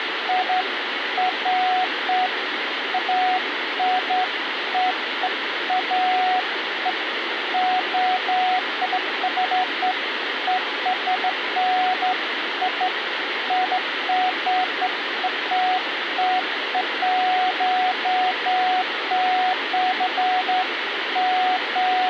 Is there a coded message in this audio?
No, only beeps of irregular length, with radio hiss.